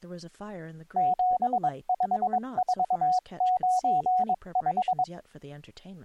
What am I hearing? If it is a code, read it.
Morse code, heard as a keyed tone, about 22 wpm, 740 Hz, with speech in English. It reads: 75495